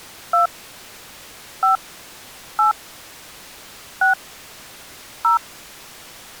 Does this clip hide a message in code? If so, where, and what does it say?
Yes: DTMF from 0.3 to 5.4 s, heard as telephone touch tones, dialled by hand, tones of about 130 ms. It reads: 2 5 8 6 0